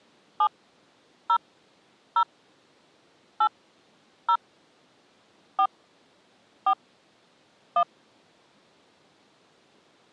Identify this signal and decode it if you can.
DTMF, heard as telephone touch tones, dialled by hand, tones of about 70 ms. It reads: 7 0 0 8 0 4 4 1